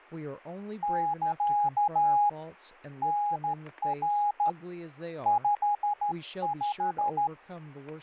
Morse code, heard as a keyed tone, hand-sent with a straight key, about 13 wpm, 830 Hz, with static crashes and speech in English. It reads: <KA> NR 55